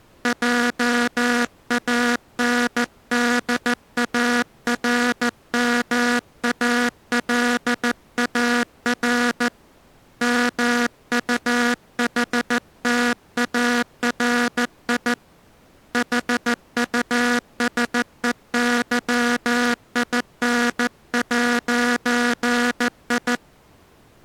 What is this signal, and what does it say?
Morse code, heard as a buzzer, hand-sent with a paddle, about 14 wpm. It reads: JANDARMALAR MUHTARI HUSEYIN'I